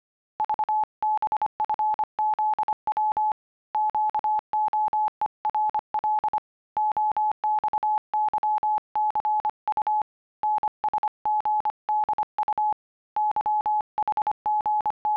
Morse code, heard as a keyed tone, hand-sent with a paddle, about 25 wpm, 850 Hz. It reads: VBFZW QOERL OXYCU NSGDU …